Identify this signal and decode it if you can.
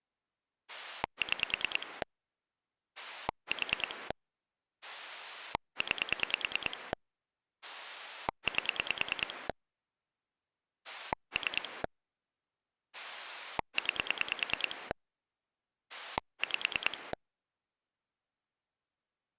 Pulse dialling, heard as a rotary dial, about 9 pulses a second. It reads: 6 4 9 8 3 9 5